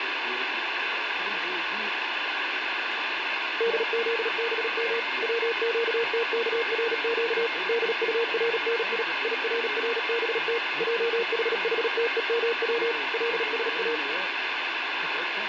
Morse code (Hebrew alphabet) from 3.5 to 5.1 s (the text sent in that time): דזבם